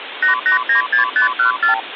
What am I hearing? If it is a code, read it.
Multi-frequency trunk signalling (R2, with the far end's replies), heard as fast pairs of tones, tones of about 120 ms, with phone line noise. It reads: 8896514